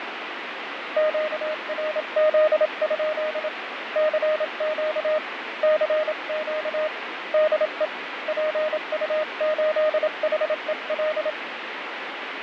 Morse code, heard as a keyed tone, hand-sent with a paddle, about 27 wpm, 620 Hz, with radio static and fading. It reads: QRZ? CQ CQ DE PU8HEL